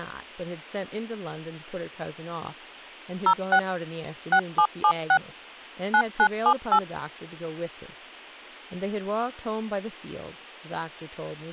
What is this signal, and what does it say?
DTMF, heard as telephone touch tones, dialled by machine, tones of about 70 ms, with speech in English. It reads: 06 6776 9978